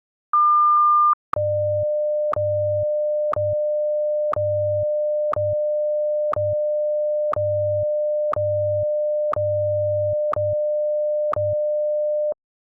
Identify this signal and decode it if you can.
Radio time signal (WWVH, Hawaii), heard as ticks, one a second.